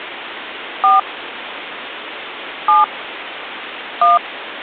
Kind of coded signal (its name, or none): DTMF